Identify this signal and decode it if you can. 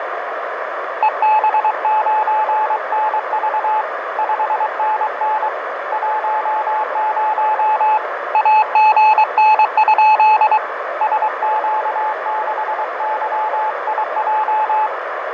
Morse code, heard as a keyed tone, hand-sent with a paddle, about 23 wpm, 860 Hz, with radio static, fading, a narrow filter and room echo. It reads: EB9NV 5NN 10 AGN? SQ6YIJ